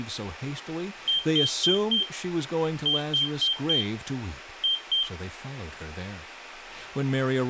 Beep code, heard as a piezo beeper, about 3150 Hz, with speech in English. 4-4-2. In Phoenix BIOS tables: parallel port failure.